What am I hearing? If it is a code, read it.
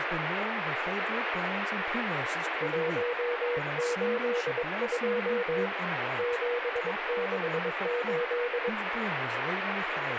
Morse code, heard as a keyed tone, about 22 wpm, 480 Hz, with radio static and speech in English. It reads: 182 768